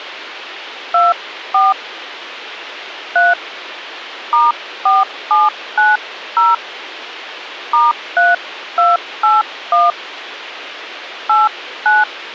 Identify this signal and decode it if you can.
DTMF, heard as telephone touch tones, dialled by hand, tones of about 180 ms, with radio hiss. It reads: 24 3 *4790 *3281 89